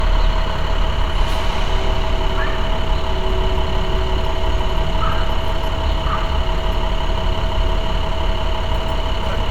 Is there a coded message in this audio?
No, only street noise.